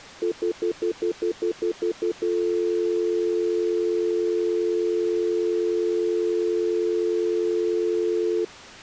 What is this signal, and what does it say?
Telephone call progress tone (North American plan), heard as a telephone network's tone, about 350, 440 Hz, 0.1 s on and 0.1 s off. Stutter dial tone.